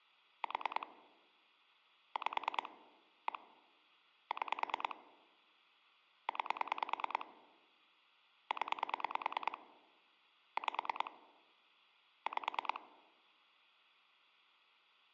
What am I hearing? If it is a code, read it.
Pulse dialling, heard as clicks on a phone line, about 9 pulses a second. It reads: 4 5 1 6 9 0 5 5